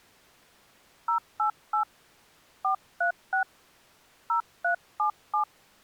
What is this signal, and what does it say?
DTMF, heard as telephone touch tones, dialled by hand, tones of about 100 ms. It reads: 088 436 0377